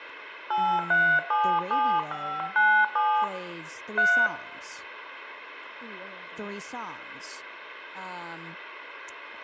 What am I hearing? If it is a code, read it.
DTMF, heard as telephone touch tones, dialled by hand, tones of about 290 ms, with room echo and speech in English. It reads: 8377597 3